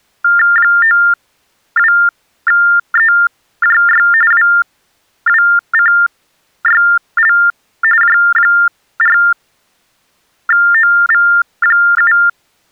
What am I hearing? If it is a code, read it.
TTY/TDD text telephone tones (45.45 baud Baudot), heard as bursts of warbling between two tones, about 400 Hz shift, 1600 Hz centre. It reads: 92EJY WWCYL J4OV7